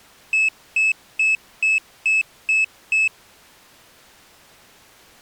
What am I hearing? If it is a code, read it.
Beep code, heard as a piezo beeper, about 2600 Hz. 7 short. In AMI BIOS tables: virtual mode exception error; in Dell tables: processor failure.